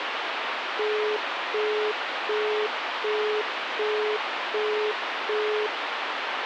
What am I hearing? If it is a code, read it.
Telephone call progress tone (as in the UK, Australia and similar networks), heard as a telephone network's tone, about 420 Hz, 0.375 s on and 0.375 s off, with phone line noise. Busy tone.